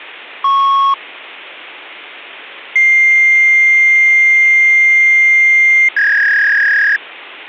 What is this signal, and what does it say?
Fax machine handshake, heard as a beep, a long tone and a warble, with phone line noise.